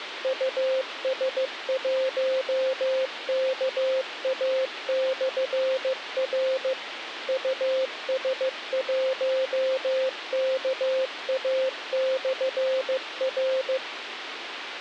Morse code, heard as a keyed tone, machine-sent, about 15 wpm, 520 Hz, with radio hiss. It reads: US1KA/R US1KA/R